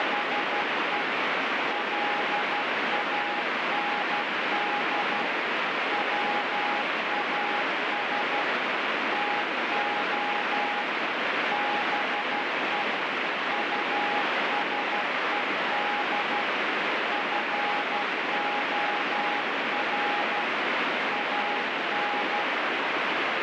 Morse code, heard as a keyed tone, machine-sent, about 12 wpm, 820 Hz, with heavy radio static. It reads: … LAND WAS TO BE USED FOR AN